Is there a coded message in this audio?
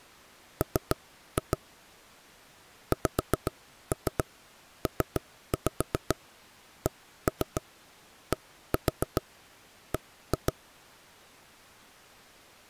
Yes: tap code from 0.6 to 10.5 s, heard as knocks on wood, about 7 knocks a second. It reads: M XPCDB